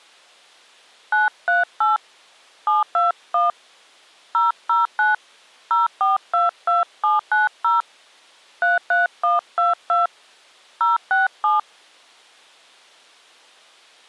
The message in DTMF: 938 721 009 0422790 33122 067

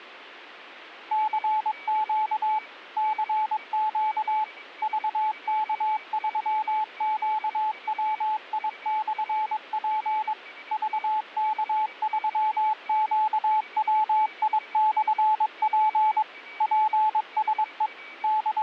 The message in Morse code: CQ CQ VK3QWI/P VK3QWI/P PSE …

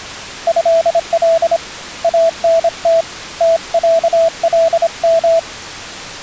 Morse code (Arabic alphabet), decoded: هل انت تعلم

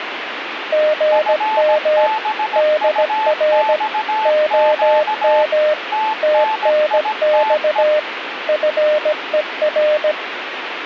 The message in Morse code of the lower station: GM DR OM TNX FER

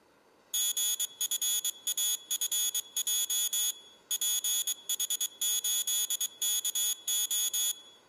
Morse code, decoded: GFAFJ PH8KO

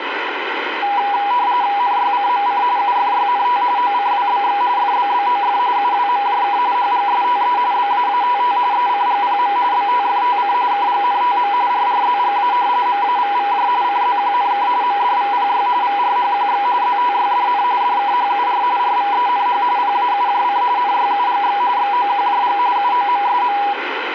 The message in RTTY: NYCMC UFYNT OCWBX FBBOF UWMJK HGSTE BAATT ECGPM BTFTC KGNTM RRZGA MAVVJ CZQNK MDVPY VRHQX ZTYDN DKHUR RVENH PAUJC NYUGX XOQJG UOMSM

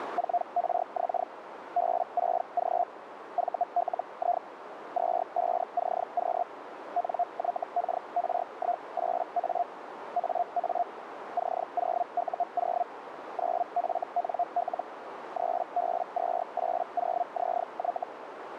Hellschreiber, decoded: 4RX B6G VLI 25CQ NYKR18A AA C0U0 9FNL 3B280ZY

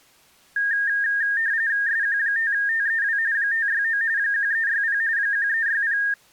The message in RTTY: SQ5TEW 569 1360 1360

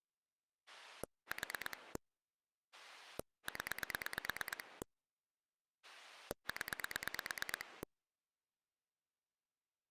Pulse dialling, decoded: 4 0 0

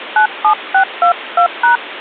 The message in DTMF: 97622#

